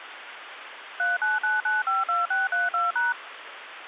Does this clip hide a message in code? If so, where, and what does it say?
Yes: DTMF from 1.0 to 3.1 s, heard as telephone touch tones, dialled by machine, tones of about 170 ms, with phone line noise. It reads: 399952632#